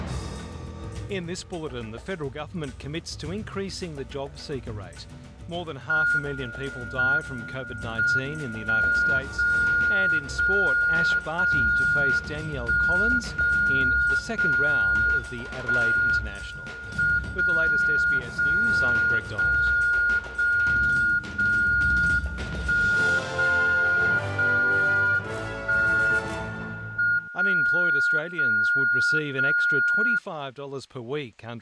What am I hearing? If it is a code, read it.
Radio time signal (WWVB), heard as a tone whose level steps once a second, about 1430 Hz. The time is 09:49 UTC. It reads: M M 1 0 0 0 1 0 0 1 M 0 0 0 0 0 1 0 0 1 M 0 0 0